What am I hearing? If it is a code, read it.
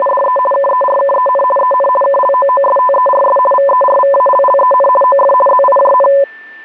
RTTY (50 baud, 450 Hz shift), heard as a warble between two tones, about 780 Hz centre, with a steady whistle near 1780 Hz. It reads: … KERKEN EN KLOOSTERS VERVALLEN OF ZIJN